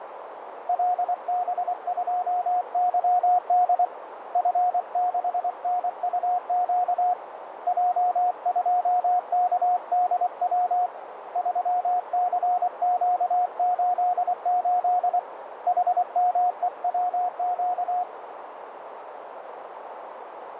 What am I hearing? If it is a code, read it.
Morse code, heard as a keyed tone, hand-sent with a paddle, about 24 wpm, 720 Hz, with radio static and a narrow filter. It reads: LB2YD F6NUQ J2KDW 3CQ88 HMEWQ